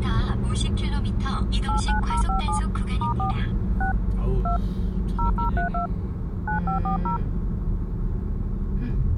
DTMF, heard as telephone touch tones, dialled by hand, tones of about 120 ms, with the noise inside a car. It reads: 89057 *4 6 2 0032 9540